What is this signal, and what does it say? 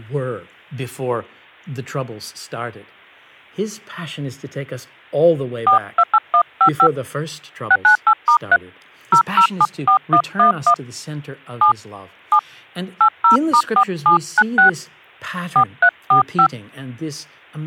DTMF, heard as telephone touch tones, dialled by hand, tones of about 80 ms, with speech in English. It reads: 428155 698*3 0074111 7 7 80*4796 4345